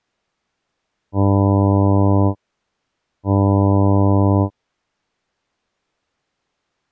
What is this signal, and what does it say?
Ship horn signal, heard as a ship's horn, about 100 Hz. 2 short. At sea: I am altering course to port.